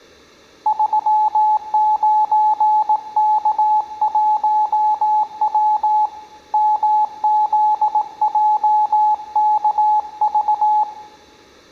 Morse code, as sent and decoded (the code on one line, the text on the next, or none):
...-- ----. -.- .---- .-- / -- --.. .--- -.- ...-
39K1W MZJKV